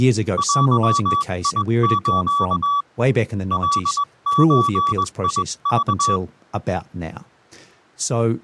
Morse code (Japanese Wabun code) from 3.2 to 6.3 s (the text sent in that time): カゾク